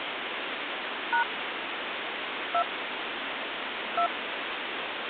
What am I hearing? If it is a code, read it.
DTMF, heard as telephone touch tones, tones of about 80 ms, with phone line noise. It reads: # 2 2